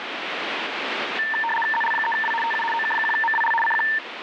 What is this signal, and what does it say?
RTTY (75 baud, 850 Hz shift), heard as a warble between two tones, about 1350 Hz centre, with radio static. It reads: ZL3W TU OK1MWL CQ